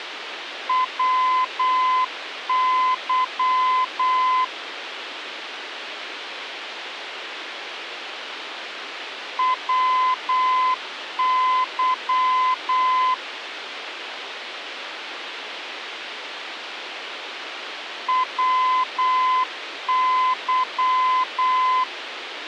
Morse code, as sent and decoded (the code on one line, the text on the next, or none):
.-- -.-- / .-- -.-- / .-- -.--
WY WY WY